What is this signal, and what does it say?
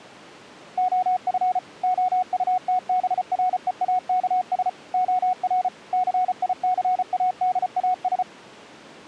Morse code, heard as a keyed tone, machine-sent, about 34 wpm, 740 Hz. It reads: OF OUTBREAKS OR CICADAS